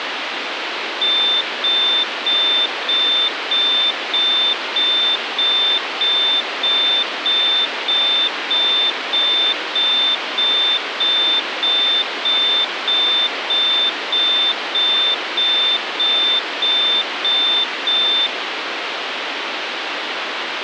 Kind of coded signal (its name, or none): none